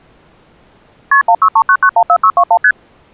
Multi-frequency trunk signalling (R1, as on North American trunks), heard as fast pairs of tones, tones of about 70 ms. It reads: KP 1639914621 ST